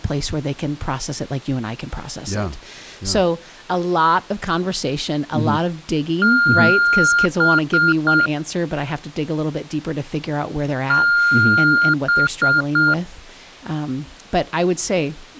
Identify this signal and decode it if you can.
Beep code, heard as beeps, played twice, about 1410 Hz, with speech in English. 1 long, 3 short. In Award and IBM BIOS tables: video adapter failure; in AMI BIOS tables: memory failure.